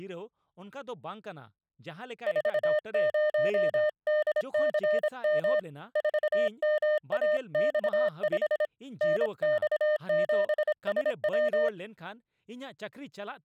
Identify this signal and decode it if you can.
Morse code, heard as a keyed tone, hand-sent with a paddle, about 26 wpm, 610 Hz, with speech in Santali. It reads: 40DCM 4MAX5 NX7SW